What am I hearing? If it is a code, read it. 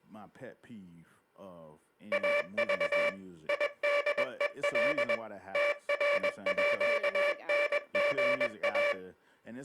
Morse code (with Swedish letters), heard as a buzzer, machine-sent, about 21 wpm, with speech in English. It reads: AV IDEL TRÅNGA